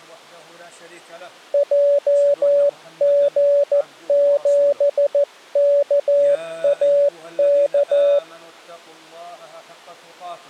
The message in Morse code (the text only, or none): JG7KAK